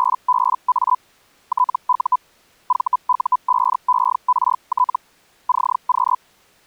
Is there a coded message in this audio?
Yes: Hellschreiber (Feld-Hell, 122.5 baud) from 0.0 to 6.2 s, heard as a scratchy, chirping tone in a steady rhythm, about 1000 Hz. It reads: … TU VU5ERT CQ